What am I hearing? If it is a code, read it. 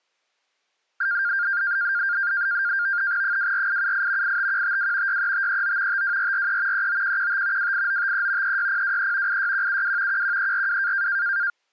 NAVTEX (SITOR-B), 100 baud, 170 Hz shift, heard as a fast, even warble, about 1500 Hz centre. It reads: 24878 85152 63539 52443 39115 28953 36023 86172 11342